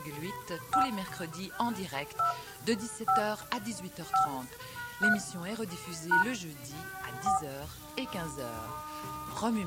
DTMF, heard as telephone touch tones, dialled by hand, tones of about 120 ms, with room echo. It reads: 5 2 5 5 3 # 4